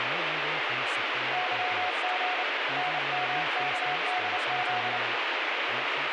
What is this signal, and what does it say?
Morse code, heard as a keyed tone, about 29 wpm, 730 Hz, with heavy radio static and speech in English. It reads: YG NMKDZ